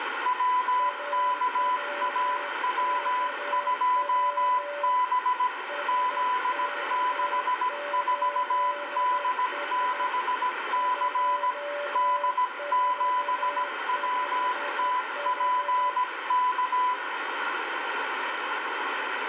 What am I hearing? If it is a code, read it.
Morse code, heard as two keyed tones, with radio static. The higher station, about 17 wpm, 1000 Hz: WKAW2B Z64D6C D7WTPK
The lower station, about 12 wpm, 580 Hz: AWKW SK8S 245H